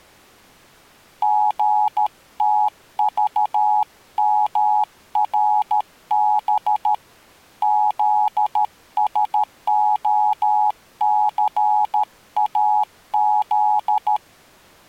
Morse code, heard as a keyed tone, hand-sent with a paddle, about 13 wpm, 840 Hz. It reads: GTVMRB ZSOCAZ